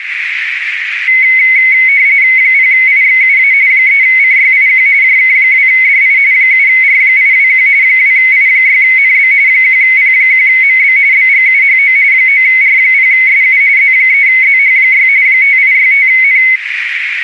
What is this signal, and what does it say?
RTTY (45.45 baud, 170 Hz shift), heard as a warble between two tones, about 2150 Hz centre, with radio static and a narrow filter. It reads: 0IXUA 3CYIQ JK2DI 7R821 2I6NB 1P1MB BGUHO 9R0SU Z3ZH6 5865N